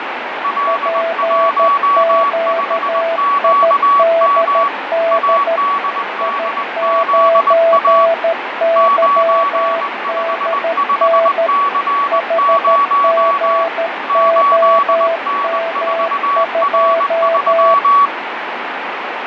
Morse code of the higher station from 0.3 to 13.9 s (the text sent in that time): L15QM ADDZA 955C0